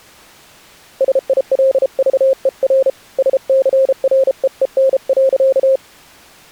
Morse code, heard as a keyed tone, hand-sent with a paddle, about 33 wpm, 530 Hz. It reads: SILVER SCREEN.